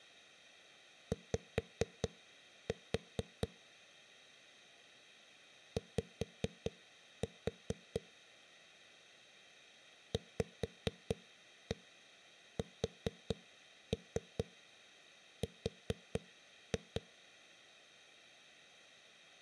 Tap code, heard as knocks on a wall, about 4 knocks a second. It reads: Y Y VSR